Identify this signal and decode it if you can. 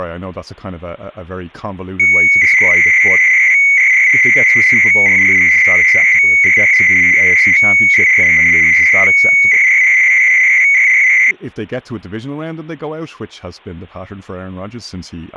300-baud modem data (Bell 103 tones), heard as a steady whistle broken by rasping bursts, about 300 baud, 200 Hz shift, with speech in English.